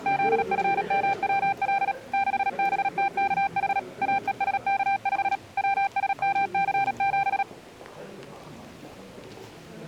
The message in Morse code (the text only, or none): ZFMWL 6BTKH AESK5 WSMC7